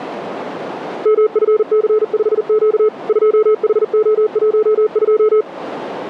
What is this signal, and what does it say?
Morse code, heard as a keyed tone, machine-sent, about 40 wpm, 430 Hz, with radio static and a narrow filter. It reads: MFC5Q 2HO12